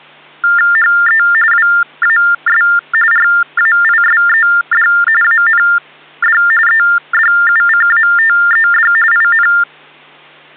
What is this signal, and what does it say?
TTY/TDD text telephone tones (45.45 baud Baudot), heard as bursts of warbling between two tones, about 400 Hz shift, 1600 Hz centre, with hum. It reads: HE WAS RAISED AND EDUCATED IN